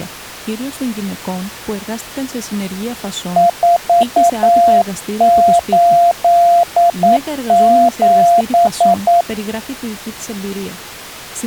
Morse code, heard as a keyed tone, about 9 wpm, 690 Hz. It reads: 487